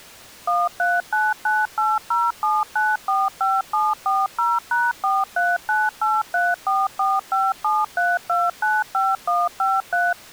DTMF, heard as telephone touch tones, dialled by machine, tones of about 200 ms. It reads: 1399807945740#4398344573295153